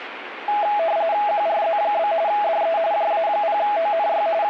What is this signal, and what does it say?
RTTY (45.45 baud, 170 Hz shift), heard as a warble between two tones, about 740 Hz centre, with radio static. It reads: QRZ? DE JA0ONY …